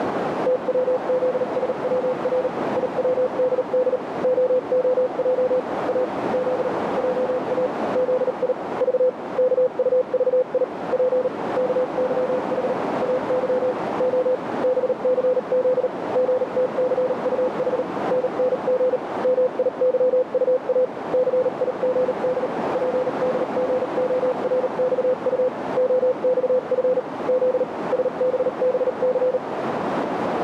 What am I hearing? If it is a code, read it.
Morse code, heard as a keyed tone, machine-sent, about 38 wpm, spaced as for 34 wpm, 510 Hz, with heavy radio static and a narrow filter. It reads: TWZSWR IWDD OOJ A Z JA ZI V KUVI P KYH AY O BCZ GTCUH NNG MIYUA CIGD PDGORXU OXF Z SBBC